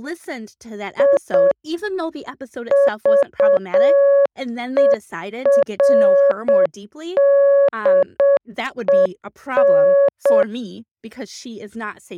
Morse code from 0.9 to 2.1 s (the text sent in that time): I